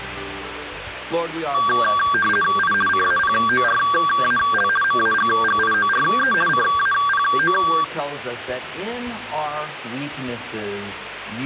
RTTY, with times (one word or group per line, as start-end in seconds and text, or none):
2.6-2.7 I
2.9-4.7 CAPORAL
4.8-6.3 MAGGIORE
6.5-7.5 CAPO